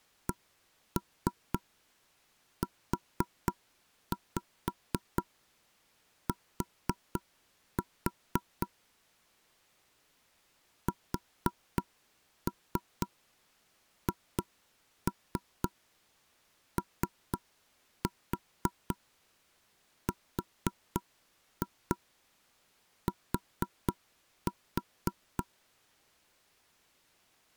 Tap code, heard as knocks on wood, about 4 knocks a second. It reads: CUT SHORT